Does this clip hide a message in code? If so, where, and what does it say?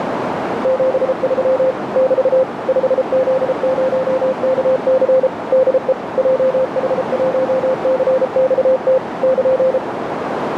Yes: Morse code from 0.6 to 9.8 s, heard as a keyed tone, machine-sent, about 33 wpm, 520 Hz, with radio static and a narrow filter. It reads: 73 <BT> 5Z0KC DE JH1CXT <KN>